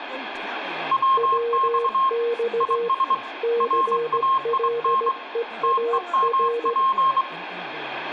Morse code, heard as two keyed tones, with radio static, room echo and speech in English. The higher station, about 24 wpm, 1070 Hz: WX IS RAIN TEMP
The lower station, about 17 wpm, 470 Hz: WX CLEAR